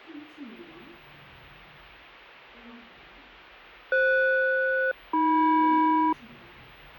Aircraft SELCAL, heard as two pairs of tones, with the noise inside a lift. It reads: FS-AM